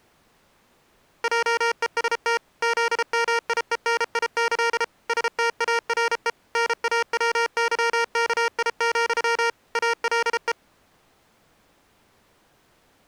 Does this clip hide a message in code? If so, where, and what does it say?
Yes: Morse code (with Polish letters) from 1.2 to 10.6 s, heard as electronic beeps, machine-sent, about 33 wpm, 460 Hz. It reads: JEST ZMIENIĆ STARE NAWYKI, ALE